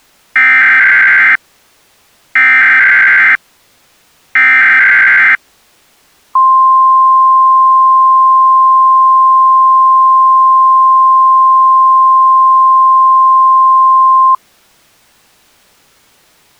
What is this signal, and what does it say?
Emergency Alert System (SAME) tones (header bursts, then the 1050 Hz attention tone), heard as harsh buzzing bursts, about 520.83 baud.